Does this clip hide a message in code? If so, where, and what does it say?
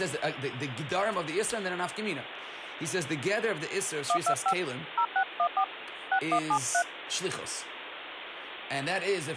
Yes: DTMF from 4.1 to 6.8 s, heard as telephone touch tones, dialled by hand, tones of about 80 ms, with phone line noise and speech in English. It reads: 125 0614 6173